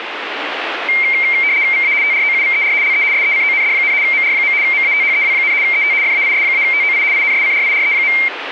RTTY (75 baud, 170 Hz shift), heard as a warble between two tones, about 2200 Hz centre, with radio static. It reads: VA TROUVER LE SECOND, MR. MATHEW, ET FAIS-TOI INSCRIRE.